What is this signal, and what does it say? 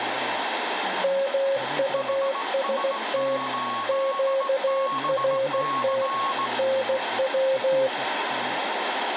Morse code, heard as two keyed tones, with radio static and speech in Portuguese. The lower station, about 16 wpm, 540 Hz: MUST QRT NW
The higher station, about 18 wpm, 1100 Hz: HS8BC